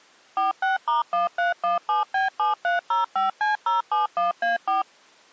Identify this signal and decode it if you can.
DTMF, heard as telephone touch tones, dialled by machine, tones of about 140 ms. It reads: 46*1317B7305C071A4